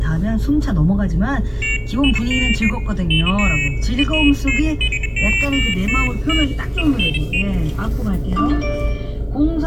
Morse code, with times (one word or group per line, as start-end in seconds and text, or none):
none